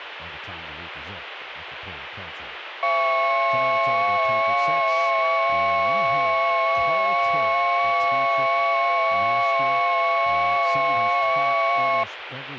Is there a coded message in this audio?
Yes: FT8 (several signals at once) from 2.8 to 12.0 s, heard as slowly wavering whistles, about 6.25 baud, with radio static and speech in English.